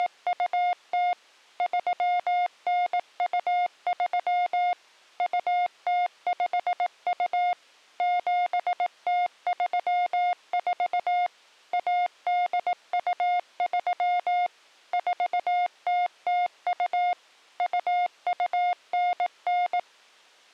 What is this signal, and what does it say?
Morse code (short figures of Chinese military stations), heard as a keyed tone, machine-sent, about 18 wpm, 710 Hz. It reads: … 3923 2052 7034 1823 4002 2299